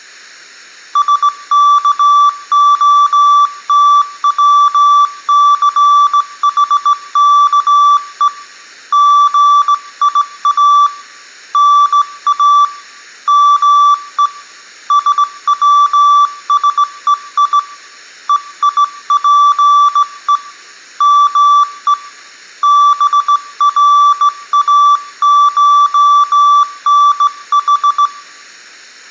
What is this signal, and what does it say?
Morse code (Greek alphabet), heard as a keyed tone, hand-sent with a straight key, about 17 wpm, 1160 Hz, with room echo. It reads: ΣΚΟΤΩΘΗΚΕ ΓΙΑ ΝΑ ΜΕ ΣΩΣΕΙ ΕΙΠΕ ΜΕ ΒΡΑΧΝΗ